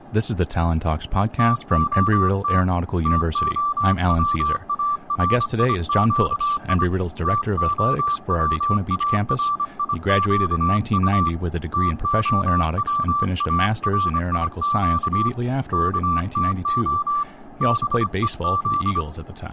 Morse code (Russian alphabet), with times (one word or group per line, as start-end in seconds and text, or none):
1.4-2.6 ТОТ
3.1-6.8 ТОВАРИЩИ
7.3-11.3 ТОВАРИЩУ
11.7-15.3 ТОВАРИЩ
15.7-17.2 КТО
17.6-19.0 БЕЗ